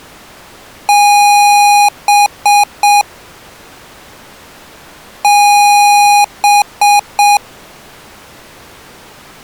Beep code, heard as beeps from a small speaker, played twice, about 820 Hz. 1 long, 3 short. In Award and IBM BIOS tables: video adapter failure; in AMI BIOS tables: memory failure.